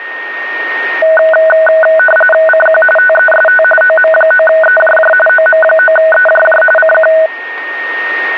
RTTY (45.45 baud, 850 Hz shift), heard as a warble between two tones, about 1060 Hz centre, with a steady whistle near 1850 Hz. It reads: CQ TEST OM9EJJ OM9EJJ CQ